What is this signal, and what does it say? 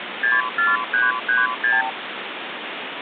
Multi-frequency trunk signalling (R2, with the far end's replies), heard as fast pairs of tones, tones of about 180 ms, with phone line noise. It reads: 64336